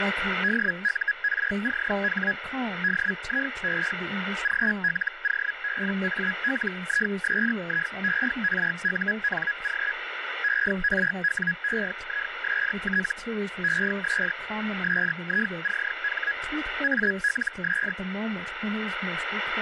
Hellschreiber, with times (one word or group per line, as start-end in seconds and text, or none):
0.4-2.3 DURCH
2.8-3.9 DIE
4.4-9.9 GLOBALISIERUNG
10.4-13.1 ERWEIST
13.6-14.3 ES
14.8-16.3 SICH
16.8-17.9 ALS